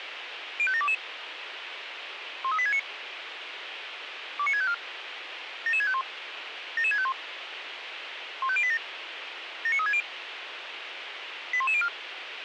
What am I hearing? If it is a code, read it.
Five-tone selective call (ZVEI), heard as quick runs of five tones, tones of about 70 ms, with radio hiss and a squelch burst at the end. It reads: 05722 13869 29654 77651 77651 15087 79360 81104